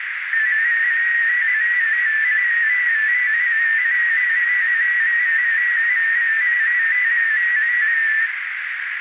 Multi-tone FSK (Olivia or MFSK type), about 250 Hz wide, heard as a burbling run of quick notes, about 15.625 baud, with radio static and a narrow filter.